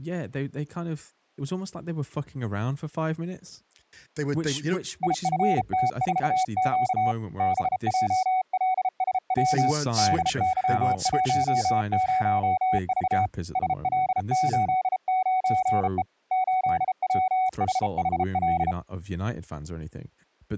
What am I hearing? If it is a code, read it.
Morse code, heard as a keyed tone, hand-sent with a bug key, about 33 wpm, 750 Hz, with speech in English. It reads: IFT4Q BJLSW DY10V SL89E 8WHHL